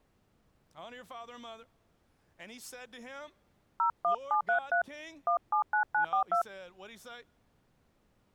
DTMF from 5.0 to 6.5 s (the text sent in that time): 179942